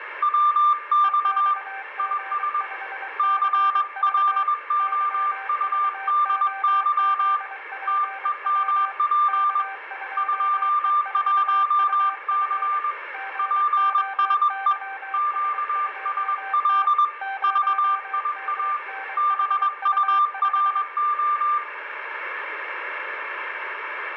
Morse code, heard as two keyed tones, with radio static and room echo. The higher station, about 21 wpm, 1190 Hz: WX IS CLOUDY TEMP 21C PSE QSL VIA BURO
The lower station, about 23 wpm, 780 Hz: EXG5CV YVOZPW K2E4UF GOYS2T 0MNHU5